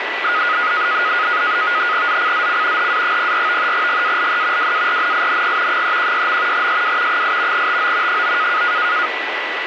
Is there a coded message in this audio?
Yes: NAVTEX (SITOR-B), 100 baud, 170 Hz shift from 0.2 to 9.1 s, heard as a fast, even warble, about 1350 Hz centre, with radio static and a steady whistle near 1970 Hz. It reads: ZCZC HA04 GALE WARNING 316. SW 8 TO 9